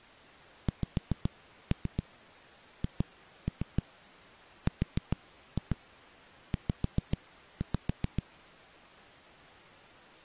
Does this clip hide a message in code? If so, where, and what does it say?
Yes: tap code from 0.7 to 8.2 s, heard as knocks on a wall, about 7 knocks a second. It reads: XHRZ